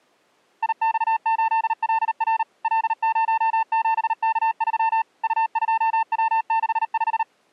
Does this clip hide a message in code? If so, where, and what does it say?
Yes: Morse code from 0.6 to 7.3 s, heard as a keyed tone, machine-sent, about 38 wpm, 900 Hz. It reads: IX8LR L07K3 U2W65